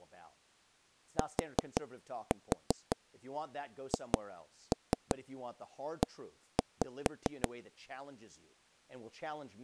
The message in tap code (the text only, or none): THE